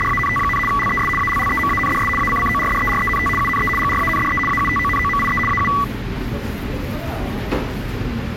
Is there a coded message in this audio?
Yes: RTTY (75 baud, 850 Hz shift) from 0.0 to 5.8 s, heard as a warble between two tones, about 1550 Hz centre, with the noise of a subway station. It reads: … LES ALLEMANDS ACCORDERENT UNE GRANDE AUTONOMIE AU